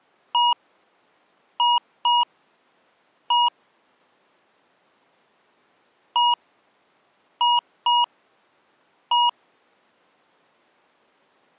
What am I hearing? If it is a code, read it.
Beep code, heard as beeps from a small speaker, played twice, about 960 Hz. 1-2-1. In Phoenix BIOS tables: interval timer failure.